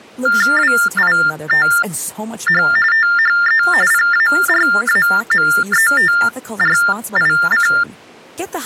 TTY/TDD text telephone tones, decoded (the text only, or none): WITH THE PARAMETRIC